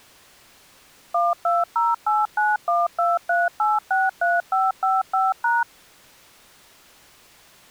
DTMF, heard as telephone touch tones, dialled by machine, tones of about 190 ms. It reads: 12089123863555#